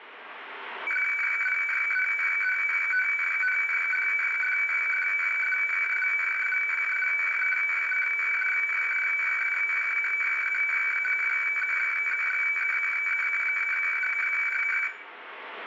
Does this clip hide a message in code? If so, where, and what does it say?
Yes: weather fax (radiofax), 120 lines a minute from 0.9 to 14.9 s, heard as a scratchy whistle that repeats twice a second, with room echo.